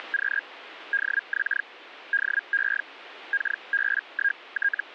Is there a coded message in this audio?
Yes: Hellschreiber (Feld-Hell, 122.5 baud) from 0.0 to 4.9 s, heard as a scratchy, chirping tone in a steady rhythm, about 1600 Hz, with radio static. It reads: … DX DE …